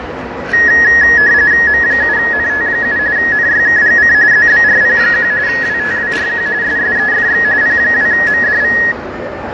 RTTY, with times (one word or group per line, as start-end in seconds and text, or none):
1.7-3.0 M7NT7
3.2-4.1 NYKGC
4.3-5.3 ZBRP1
5.5-6.5 WTWRQ
6.6-7.4 SSEFX
7.6-8.8 P2MDV